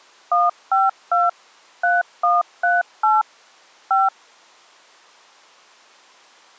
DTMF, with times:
0.3-1.3 152
1.8-3.2 3138
3.9-4.1 5

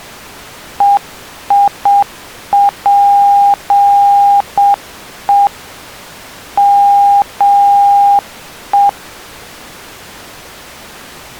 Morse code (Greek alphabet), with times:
0.8-5.5 ΕΙΠΕ
6.6-8.9 ΜΕ

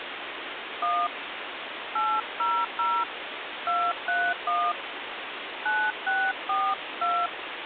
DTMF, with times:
0.8-1.1 1
2.0-3.0 800
3.7-4.7 231
5.7-7.3 9642

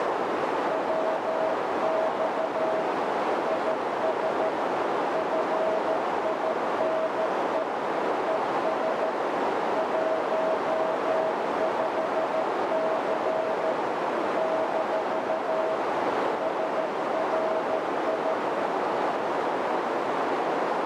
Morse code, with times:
0.7-2.8 WX
3.5-4.5 IS
5.1-7.6 FINE
8.3-9.1 ES
9.8-13.7 15C
14.4-15.7 -
16.4-18.3 SRI

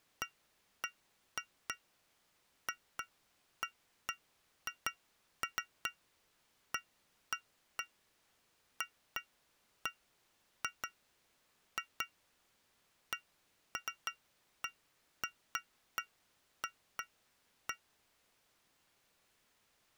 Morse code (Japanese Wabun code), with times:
none

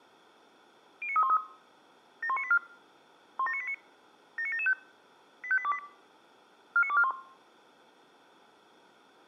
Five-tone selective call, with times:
1.0-1.4 09313
2.2-2.6 71984
3.4-3.7 17989
4.4-4.7 79775
5.4-5.8 85828
6.8-7.1 49241

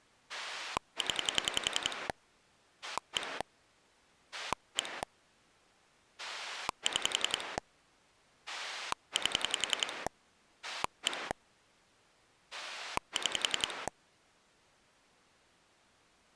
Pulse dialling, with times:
0.3-2.1 0
2.8-3.4 1
4.3-5.0 1
6.2-7.6 6
8.5-10.1 8
10.6-11.3 1
12.5-13.9 6

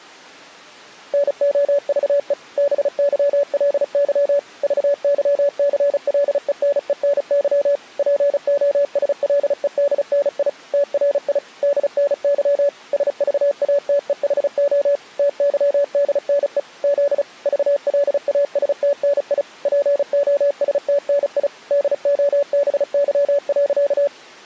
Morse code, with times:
1.1-2.3 NOVE
2.6-4.4 BYLY
4.6-7.8 VYCLENENY
8.0-10.5 POSLEDNI
10.7-11.4 TRI
11.6-12.7 DNY
12.9-15.0 SVATEHO
15.2-16.6 TYDNE
16.8-17.2 Z
17.5-19.4 VLASTNI
19.7-21.5 POSTNI
21.7-24.1 DOBY.

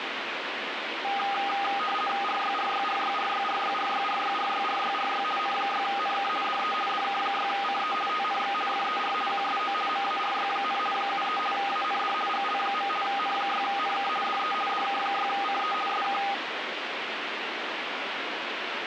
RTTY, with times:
2.2-5.2 RYRYRYRYRYRYRYRYRYRY
5.4-6.3 N6NK
6.4-6.7 DE
6.9-7.9 DK6CE
8.1-8.5 TNX
8.7-9.1 FER
9.3-9.7 QSO
9.9-10.8 MARY,
10.9-11.4 73
11.5-12.1 AND
12.3-12.9 GL.
13.0-14.1 N6NK
14.2-14.5 DE
14.7-15.7 DK6CE
15.9-16.2 SK

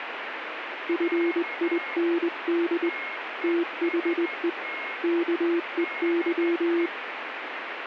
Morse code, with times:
0.9-2.9 FIND
3.4-4.5 THE
5.0-6.9 KEY

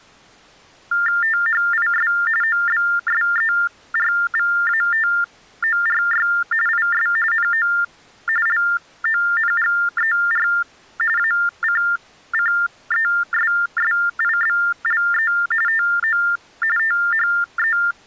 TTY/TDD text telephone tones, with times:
1.2-2.1 THIS
2.4-6.3 OBSERVATORY
6.7-7.1 IS
7.3-7.7 NO
8.5-10.5 LONGER
11.2-15.3 ACCESSIBLE
15.7-16.2 TO
16.8-17.8 THE

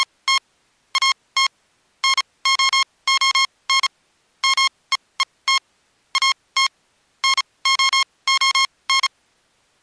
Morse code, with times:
0.0-0.4 …
1.0-1.5 AT
2.0-3.9 NOON
4.4-5.6 MEET
6.2-6.7 AT
7.2-9.1 NOON

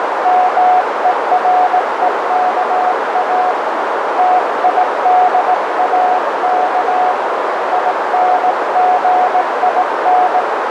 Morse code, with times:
0.3-3.5 MEREKA
4.2-7.1 TIDAK
7.7-10.4 INGIN

